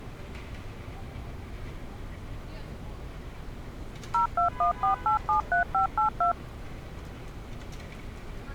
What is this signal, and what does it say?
DTMF, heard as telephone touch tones, dialled by machine, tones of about 110 ms, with street noise. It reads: 0214873582